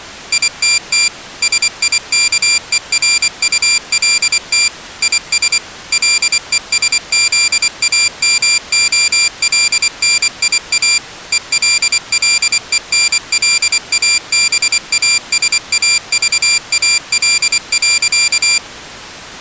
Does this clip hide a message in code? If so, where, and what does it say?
Yes: Morse code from 0.3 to 18.6 s, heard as a high beeper, machine-sent, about 24 wpm, 2400 Hz. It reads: ITT SIKERULT IS LESZAMOLNIA ELLENLABASAVAL.